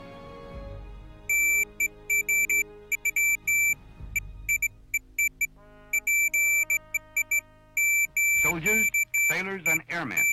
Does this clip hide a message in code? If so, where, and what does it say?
No, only beeps of irregular length.